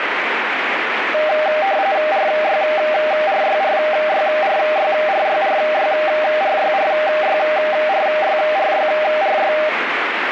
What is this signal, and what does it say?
RTTY (45.45 baud, 170 Hz shift), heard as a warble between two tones, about 700 Hz centre, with radio static. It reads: RYRYRYRYRYRYRYRYRYRYRY